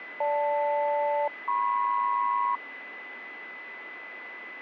Aircraft SELCAL, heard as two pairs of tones, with radio static and a steady whistle near 2010 Hz. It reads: GL-MP